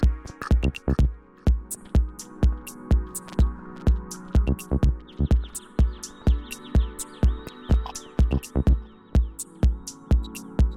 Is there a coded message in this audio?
No.